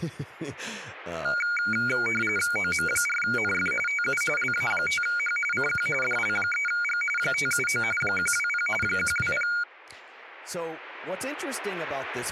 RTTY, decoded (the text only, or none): OM4NF TU LA5H CQ DL3G 579 120 120